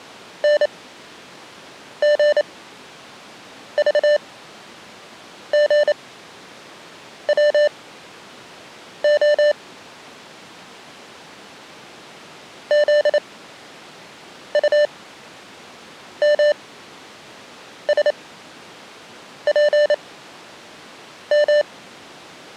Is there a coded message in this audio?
Yes: Morse code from 0.4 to 21.7 s, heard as electronic beeps, machine-sent, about 28 wpm, spaced as for 6 wpm, 590 Hz. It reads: NGVGWO ZUMSPM